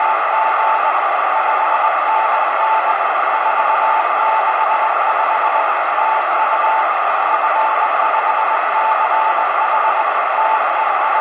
Morse code, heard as a keyed tone, hand-sent with a paddle, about 20 wpm, 880 Hz, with heavy radio static and a narrow filter. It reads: … 5NN 465 TU F5CH …